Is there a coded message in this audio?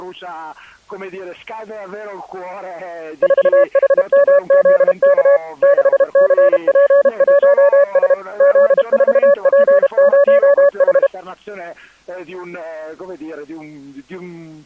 Yes: Morse code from 3.2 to 11.1 s, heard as a keyed tone, machine-sent, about 32 wpm, 570 Hz. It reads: 4HMZK 6CP1S Z4P0H